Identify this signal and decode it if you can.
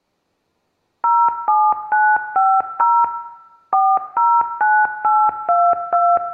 DTMF, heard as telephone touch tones, dialled by machine, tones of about 250 ms, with room echo. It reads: 07950 409822